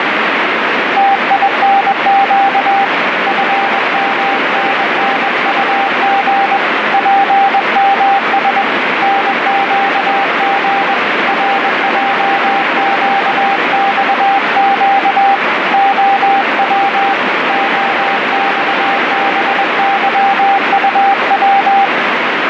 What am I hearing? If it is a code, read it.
Morse code, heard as a keyed tone, hand-sent with a paddle, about 21 wpm, 790 Hz, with heavy radio static. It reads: TINQ FMNNUG PMS NQG RJQXQ OW OXBYUW